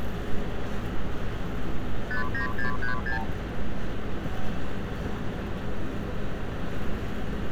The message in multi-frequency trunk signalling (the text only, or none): 59636